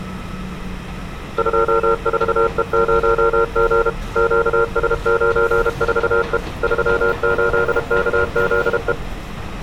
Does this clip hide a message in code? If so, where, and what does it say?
Yes: Morse code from 1.3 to 9.0 s, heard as a keyed tone, machine-sent, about 32 wpm, 460 Hz, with street noise. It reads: 24E0G QS94E 38KZE